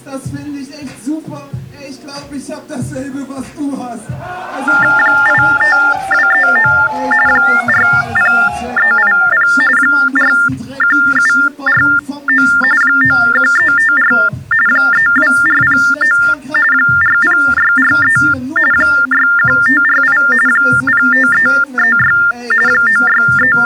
TTY/TDD text telephone tones (45.45 baud Baudot), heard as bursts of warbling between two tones, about 400 Hz shift, 1600 Hz centre. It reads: 85239 40380 41749 91354 32409 40643 61548 05336 …